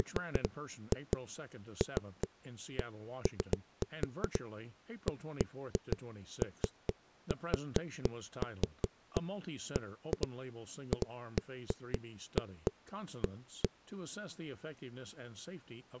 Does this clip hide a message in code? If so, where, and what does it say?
No, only irregular knocks on a wall.